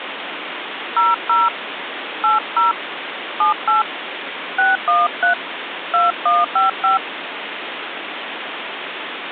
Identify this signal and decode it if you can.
DTMF, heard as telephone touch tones, dialled by hand, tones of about 150 ms, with phone line noise. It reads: 00 80 78 613 2155